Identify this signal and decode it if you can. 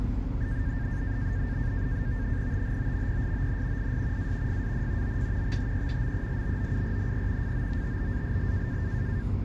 NAVTEX (SITOR-B), 100 baud, 170 Hz shift, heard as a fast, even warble, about 1700 Hz centre, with radio static and the noise inside a bus. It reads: THOMPSON IS A FAN OF THE MELBOURNE FOOTBALL